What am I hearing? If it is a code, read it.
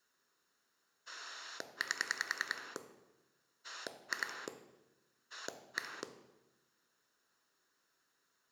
Pulse dialling, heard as a rotary dial, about 10 pulses a second, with room echo. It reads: 8 2 1